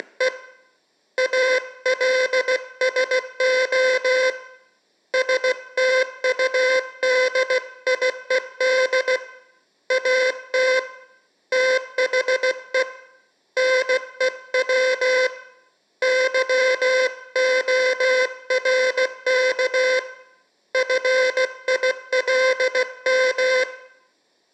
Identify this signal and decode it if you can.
Morse code, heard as a buzzer, hand-sent with a paddle, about 16 wpm, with room echo. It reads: … ALSO STUDIED AT THE NEW YORK FILM